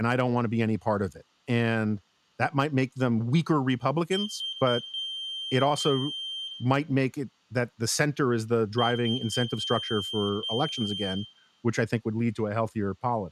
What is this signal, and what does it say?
Beep code, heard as a piezo beeper, played twice, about 3150 Hz, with room echo and speech in English. 3 short, 2 long.